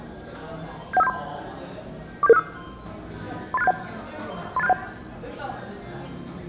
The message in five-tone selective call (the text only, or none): 71573 47765 38671 38671